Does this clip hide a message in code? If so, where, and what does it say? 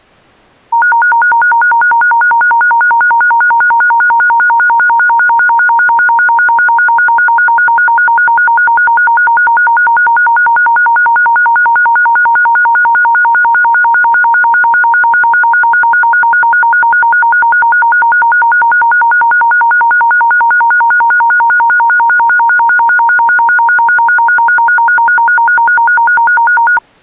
No, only a tone that alternates evenly between two pitches.